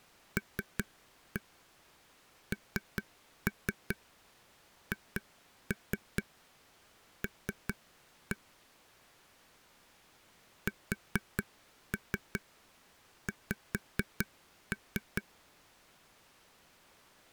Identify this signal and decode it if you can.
Tap code, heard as taps on a table, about 4 knocks a second. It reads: LNHL SX